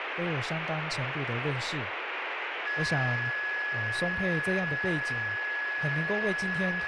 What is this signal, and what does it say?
A steady tone, with radio static and speech in Chinese. There is no code.